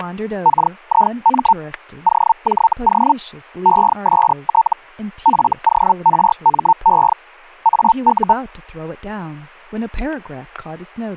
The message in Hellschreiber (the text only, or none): KIM OJO EST FORME AU